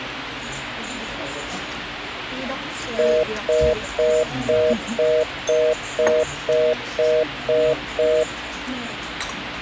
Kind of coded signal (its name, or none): telephone call progress tone